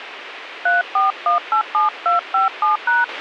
DTMF, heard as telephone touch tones, dialled by hand, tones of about 140 ms, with radio hiss and a squelch burst at the end. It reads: 34187257#